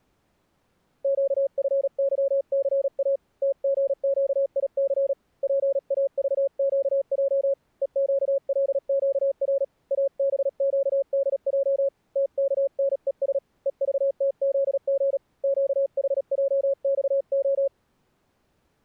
Morse code, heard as a keyed tone, hand-sent with a paddle, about 37 wpm, 550 Hz. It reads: QFYCA TGQIC PAVQJ EQLQR ABQDJ TKNES EVTZG QHJXO